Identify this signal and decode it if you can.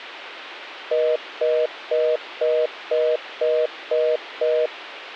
Telephone call progress tone (North American plan), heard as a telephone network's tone, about 480, 620 Hz, 0.25 s on and 0.25 s off. Congestion tone.